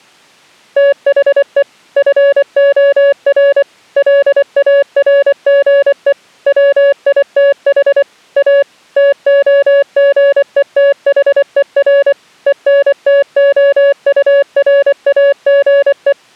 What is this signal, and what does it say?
Morse code, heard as a keyed tone, machine-sent, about 24 wpm, 560 Hz. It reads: THE FOR LARGE WITH A TOGETHER ENTOURAGE